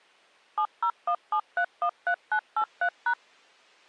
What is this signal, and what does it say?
DTMF, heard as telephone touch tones, dialled by machine, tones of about 80 ms. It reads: 7017313983#